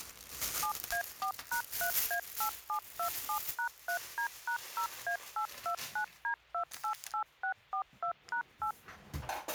DTMF, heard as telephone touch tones, dialled by machine, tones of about 90 ms, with a squelch burst at the end and kitchen noise. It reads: 7A4#3A8727#3D#0A829D288642#8